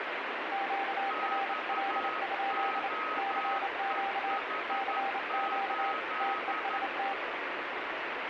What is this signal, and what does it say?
Morse code, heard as two keyed tones, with heavy radio static. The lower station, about 28 wpm, 790 Hz: QRL? CQ CQ TEST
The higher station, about 12 wpm, 1270 Hz: XOEH8